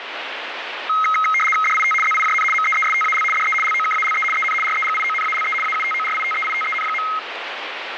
RTTY (75 baud, 850 Hz shift), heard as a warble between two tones, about 1700 Hz centre, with radio static. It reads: DIT ZIJN MEESTAL DE LOKALE EN REGIONALE AUTORITEITEN.